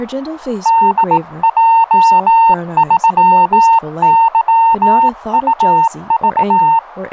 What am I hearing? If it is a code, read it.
Morse code, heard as a keyed tone, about 18 wpm, 910 Hz, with radio static and speech in English. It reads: DJ3YUV